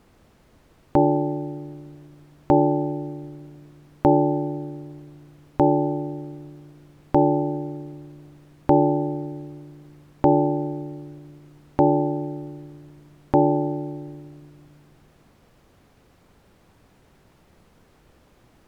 Clock strike, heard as a bell. 9. Nine o'clock.